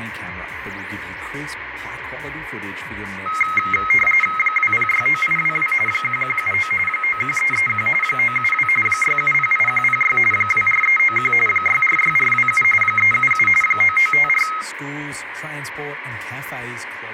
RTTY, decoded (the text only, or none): 2069822 1179 91331 972 6708106 24391 646427 377 9954